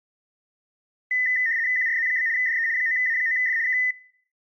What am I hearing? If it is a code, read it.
RTTY (75 baud, 170 Hz shift), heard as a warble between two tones, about 1900 Hz centre, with room echo. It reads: QRZ? DE 9A9F K